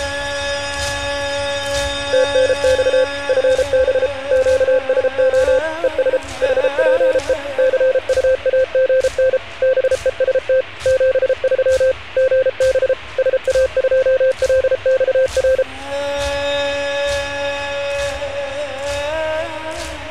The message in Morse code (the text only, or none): TNX FB QSO ES HPE CUAGN BEST 73 GB SA2LXR